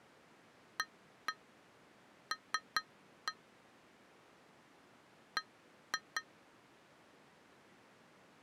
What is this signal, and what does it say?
Tap code, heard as taps on glass, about 5 knocks a second. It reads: AL B